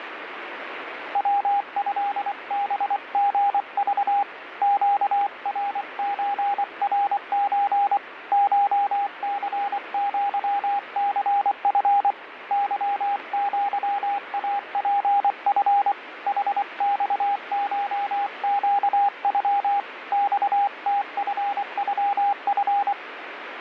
Morse code (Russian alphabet), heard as a keyed tone, hand-sent with a paddle, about 24 wpm, 810 Hz, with radio static. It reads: ВЭБГЖ ЩРЧРЧ ШЦЪЦФ ЫЪАПФ ХЬШЩЮ ЬТФЮФ